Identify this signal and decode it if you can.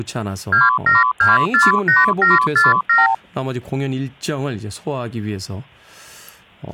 Multi-frequency trunk signalling (R2, with the far end's replies), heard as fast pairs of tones, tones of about 170 ms, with speech in Korean. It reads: 27248747